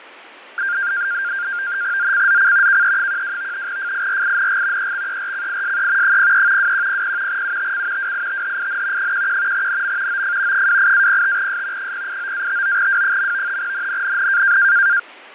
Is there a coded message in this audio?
Yes: NAVTEX (SITOR-B), 100 baud, 170 Hz shift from 0.6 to 15.0 s, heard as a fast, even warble, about 1500 Hz centre, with radio static and fading. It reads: ZCZC KE12 FIRING EXERCISE 03 2100 UTC WITHIN 11 NM OF 28-05S 089-59W. NNNN